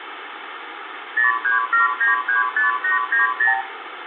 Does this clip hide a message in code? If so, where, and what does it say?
Yes: multi-frequency trunk signalling (R2, with the far end's replies) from 1.2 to 3.6 s, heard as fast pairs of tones, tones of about 140 ms, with phone line noise and room echo. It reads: 037935890